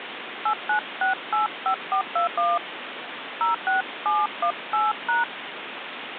DTMF, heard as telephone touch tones, dialled by hand, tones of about 140 ms, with phone line noise. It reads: 89685421 06718#